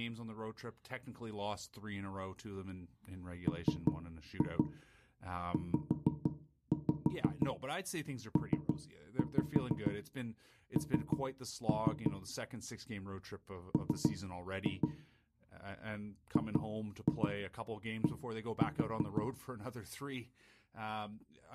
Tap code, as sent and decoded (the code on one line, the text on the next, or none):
3-2 5-5 3-5 3-3 / 3-2 / 2-2 1-4
MZPN M GD